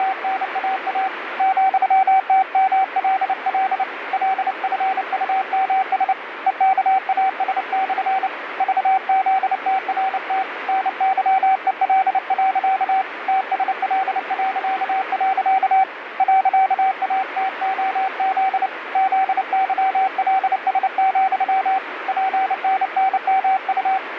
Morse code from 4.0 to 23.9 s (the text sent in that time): LFUMS EKAS/ VZTRT NYEL. TSL.. .ATOZ ZYLS, PNNMU